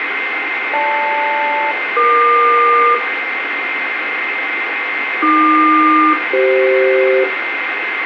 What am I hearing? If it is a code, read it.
Aircraft SELCAL, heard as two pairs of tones, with radio static, a steady whistle near 2090 Hz and room echo. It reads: GL-EQ AQ-CF